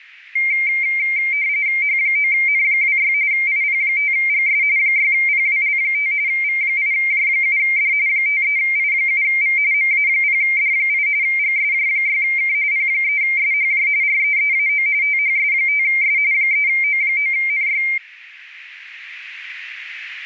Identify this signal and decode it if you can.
RTTY (45.45 baud, 170 Hz shift), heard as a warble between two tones, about 2200 Hz centre. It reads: H9N26 IP5GS 6PWL5 V8J7D 53I7V MA0D8 GSJ6K P3SHJ REEAO THS5S 3O9NY